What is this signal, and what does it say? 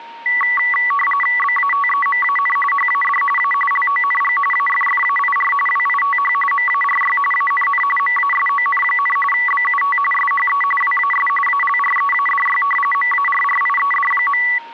RTTY (45.45 baud, 850 Hz shift), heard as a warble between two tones, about 1550 Hz centre, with a steady whistle near 930 Hz. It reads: BATEMAN HAD A LONG AFFAIR WITH MARY ANN MASON, BUT SHE WAS ALREADY MARRIED.